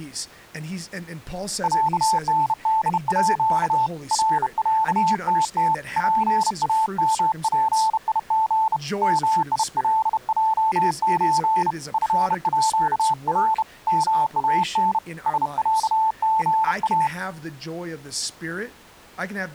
Morse code (with Swedish letters), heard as a keyed tone, hand-sent with a bug key, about 31 wpm, 880 Hz, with speech in English. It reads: ÄNDÅ RÄTT PAMPIG MILJÖ FÅR MAN SÄGA